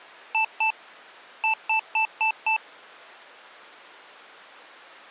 Beep code, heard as beeps from a small speaker, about 880 Hz. 2-5.